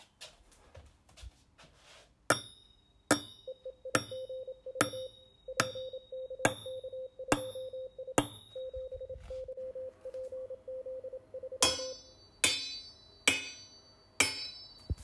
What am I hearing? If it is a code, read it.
Morse code, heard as a keyed tone, hand-sent with a paddle, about 27 wpm, 520 Hz. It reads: EEIGV PKK2I 7YPZ3